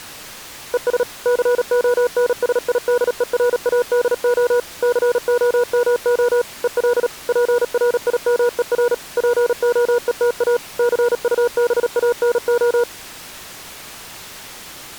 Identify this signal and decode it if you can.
Morse code, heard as a keyed tone, machine-sent, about 37 wpm, 480 Hz. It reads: ES CONSIDERADO COMO EL PRIMER POETA CUBANO